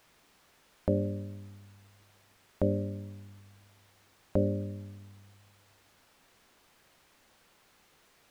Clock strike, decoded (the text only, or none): 3